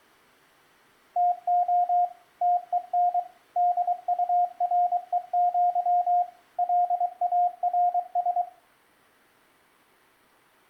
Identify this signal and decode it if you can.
Morse code (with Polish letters), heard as a keyed tone, machine-sent, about 23 wpm, 710 Hz, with room echo. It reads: TO TEN DUREŃ LARS